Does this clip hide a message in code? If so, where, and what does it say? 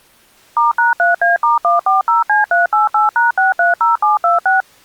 Yes: DTMF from 0.6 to 4.6 s, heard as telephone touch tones, dialled by machine, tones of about 150 ms. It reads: *#3A*140C388#630726